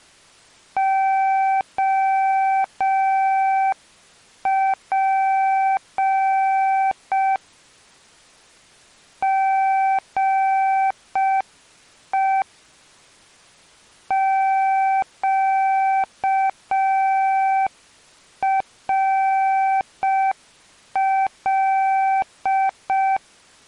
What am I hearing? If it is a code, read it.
Morse code, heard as a keyed tone, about 5 wpm, 770 Hz. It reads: OP GE QRL